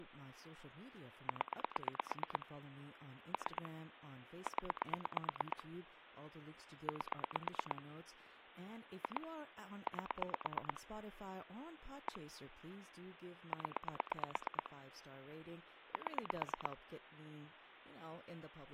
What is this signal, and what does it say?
Pulse dialling, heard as clicks on a phone line, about 8 pulses a second, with speech in English. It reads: 0 3 0 8 2 8 1 0 7